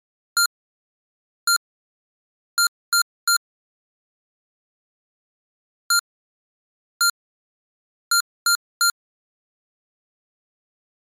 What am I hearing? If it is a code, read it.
Beep code, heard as beeps from a small speaker, played twice, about 1390 Hz. 1-1-3. In Phoenix BIOS tables: CMOS read or write failure.